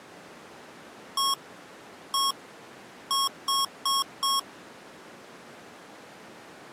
Beep code, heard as beeps from a small speaker, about 1100 Hz. 1-1-4. In Phoenix BIOS tables: BIOS ROM checksum failure.